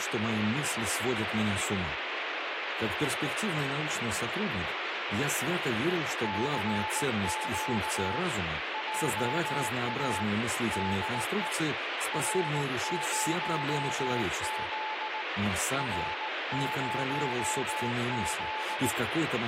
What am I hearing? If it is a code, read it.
Morse code, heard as a keyed tone, hand-sent with a paddle, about 18 wpm, 870 Hz, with radio static. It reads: CQ JA DE R0Z R0Z